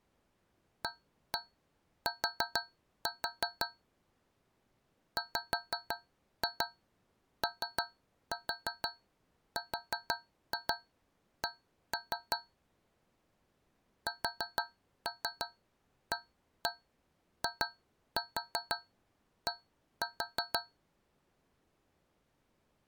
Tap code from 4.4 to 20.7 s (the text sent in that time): WORK SAID